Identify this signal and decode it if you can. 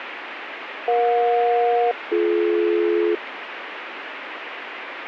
Aircraft SELCAL, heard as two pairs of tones, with radio static. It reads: EJ-BD